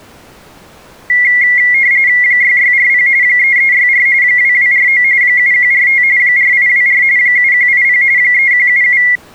RTTY (45.45 baud, 170 Hz shift), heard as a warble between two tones, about 2050 Hz centre. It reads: 6640 3364 2249 7145 4824 7180 3177